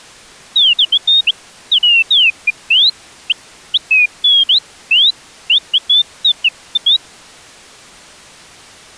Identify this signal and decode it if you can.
Bird-like chirps. There is no code.